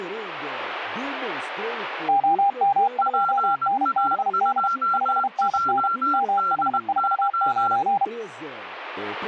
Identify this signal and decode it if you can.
Morse code, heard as two keyed tones. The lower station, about 32 wpm, 800 Hz: OM2NBD 5NN MH49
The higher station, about 20 wpm, 1370 Hz: PA2JDY